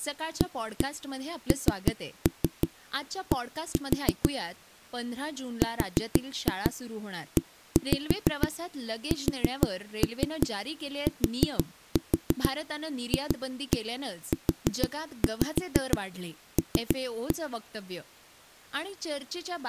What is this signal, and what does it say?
Tap code, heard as knocks on a wall, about 6 knocks a second, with speech in Gujarati. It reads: AND RESTFUL